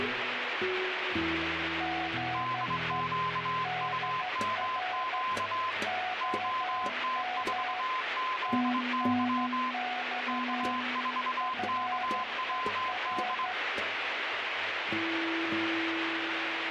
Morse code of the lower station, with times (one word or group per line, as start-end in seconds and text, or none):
1.8-3.0 GE
3.7-5.2 DR
5.9-7.8 OM
8.5-10.8 TNX
11.4-13.5 FER